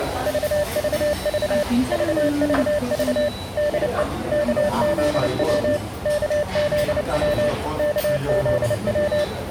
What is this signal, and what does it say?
Morse code, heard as a keyed tone, machine-sent, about 29 wpm, 590 Hz, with radio static and the noise of a restaurant. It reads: VVV VVV DE KZW KZW KZW